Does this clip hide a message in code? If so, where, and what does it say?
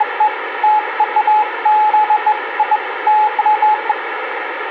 No, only beeps of irregular length, with radio static.